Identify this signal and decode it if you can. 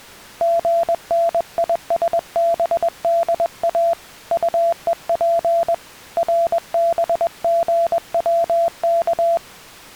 Morse code, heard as a keyed tone, hand-sent with a paddle, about 21 wpm, 680 Hz. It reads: GNISBDA UEP RBGWK